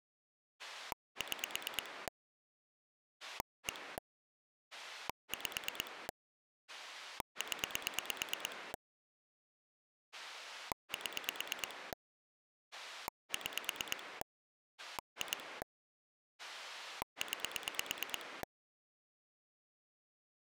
Pulse dialling, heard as a rotary dial, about 9 pulses a second. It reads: 6 1 5 0 7 6 2 9